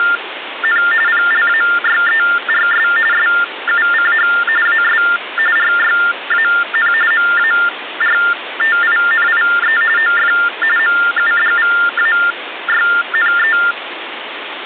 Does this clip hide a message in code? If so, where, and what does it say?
Yes: TTY/TDD text telephone tones (45.45 baud Baudot) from 0.0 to 13.7 s, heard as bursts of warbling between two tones, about 400 Hz shift, 1600 Hz centre, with phone line noise. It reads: … PLAYERS SUCH AS RYAN MARTINIE OF MUDVAYNE